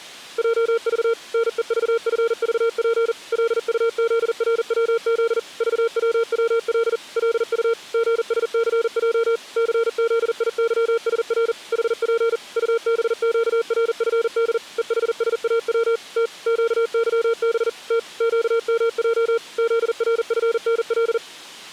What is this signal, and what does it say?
Morse code, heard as a keyed tone, machine-sent, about 40 wpm, 460 Hz. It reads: JV NEVFVP LUZRWZ VWWL LU GSCJ CZIYSR HP UBQRFD EHSAW T QYB T QMJ ZRFNL